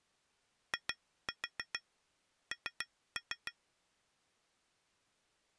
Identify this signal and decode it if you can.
Tap code, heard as taps on glass, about 7 knocks a second. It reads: IN